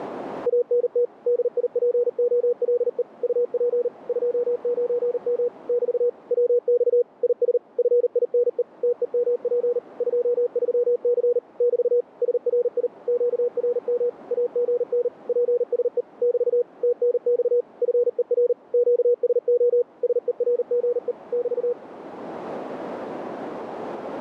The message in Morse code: ANT DIPOLE UP 29M <BT> WX IS FINE TEMP 23C <BT> SRI QRM AGN PSE <BT> TNX FER QSO SERGE <BT>

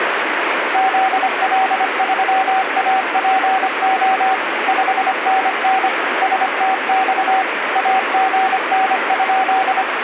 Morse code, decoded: ZL3APO 5NN STX AGN?

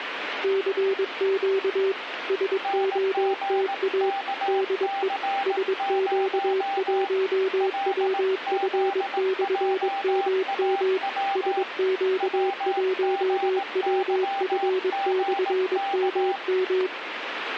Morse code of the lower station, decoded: CQ SOTA DE SQ1WF/MM SQ1WF/MM

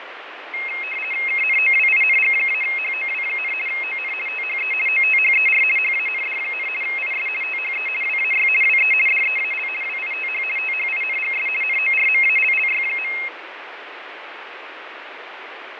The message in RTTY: KNOWING-HOW, ON THE OTHER HAND, IS THE WAY WE DEAL WITH THINGS NORMALLY.

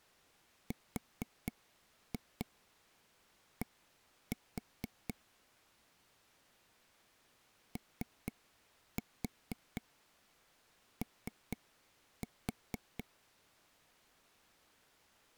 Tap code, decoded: RD OO

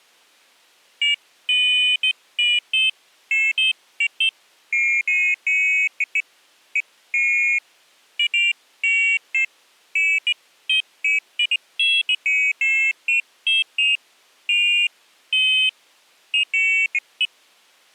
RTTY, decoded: none

